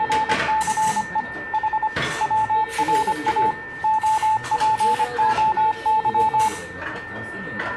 Morse code (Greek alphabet), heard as a keyed tone, machine-sent, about 25 wpm, 870 Hz, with radio static, a steady whistle near 1800 Hz, room echo and the noise of a restaurant. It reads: … Η ΩΡΑ ΟΠΟΥ